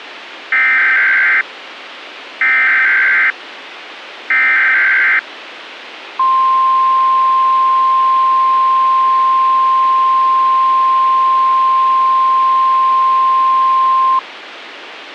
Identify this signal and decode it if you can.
Emergency Alert System (SAME) tones (header bursts, then the 1050 Hz attention tone), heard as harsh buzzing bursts, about 520.83 baud, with radio hiss.